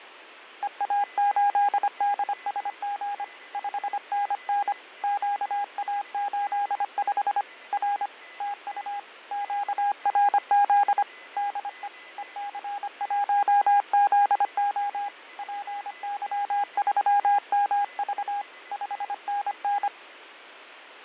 Morse code, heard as a keyed tone, hand-sent with a paddle, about 25 wpm, 810 Hz, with radio static, fading and a weaker station near 2010 Hz. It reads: EA8DSG 5NN QA85 R TU QRZ DE EC1ZO PY3MV 5NN